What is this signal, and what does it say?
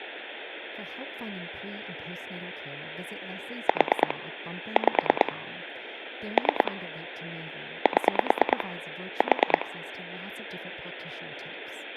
Pulse dialling, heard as clicks on a phone line, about 9 pulses a second, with phone line noise and speech in English. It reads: 4 5 3 7 4